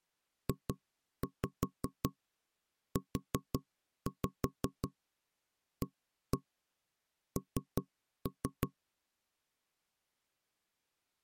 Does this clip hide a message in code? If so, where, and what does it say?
Yes: tap code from 0.5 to 8.7 s, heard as knocks on wood, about 5 knocks a second. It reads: JUAN